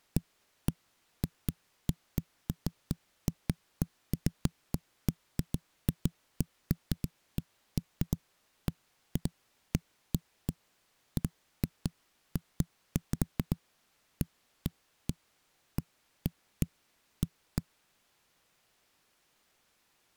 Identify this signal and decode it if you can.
Irregular knocks on a wall. There is no code.